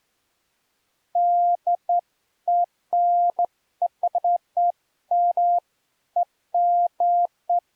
Beeps of irregular length. There is no code.